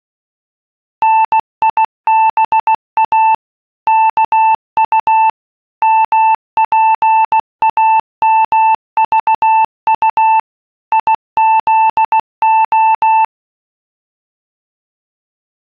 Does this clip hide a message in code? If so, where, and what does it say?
Yes: Morse code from 1.0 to 13.3 s, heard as a keyed tone, machine-sent, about 16 wpm, 880 Hz. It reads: NIBA KU MPAMVU IZO